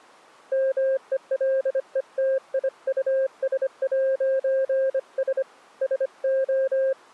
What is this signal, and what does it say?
Morse code, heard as a keyed tone, hand-sent with a bug key, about 25 wpm, 530 Hz. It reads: MELETIUS'S SO